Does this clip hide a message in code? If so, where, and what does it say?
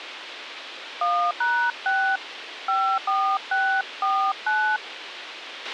Yes: DTMF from 1.0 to 4.8 s, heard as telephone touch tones, dialled by hand, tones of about 300 ms, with radio hiss and a squelch burst at the end. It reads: 1#6 54649